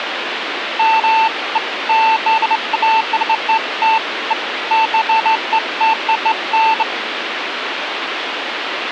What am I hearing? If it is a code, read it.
Beeps of irregular length, with phone line noise. There is no code.